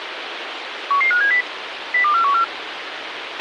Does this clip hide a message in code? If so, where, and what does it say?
Yes: five-tone selective call (CCIR) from 0.9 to 2.4 s, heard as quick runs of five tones, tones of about 100 ms, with radio hiss and a squelch burst at the end. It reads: 11570 02414